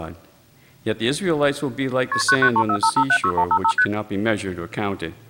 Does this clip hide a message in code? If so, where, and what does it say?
Yes: multi-frequency trunk signalling (R1, as on North American trunks) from 2.1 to 3.8 s, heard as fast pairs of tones, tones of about 70 ms. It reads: KP 99345576155 ST